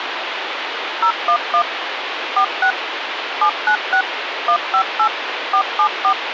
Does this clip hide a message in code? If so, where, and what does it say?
Yes: DTMF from 1.0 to 6.1 s, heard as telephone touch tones, dialled by machine, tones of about 80 ms, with phone line noise. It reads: 011 46 796 158 474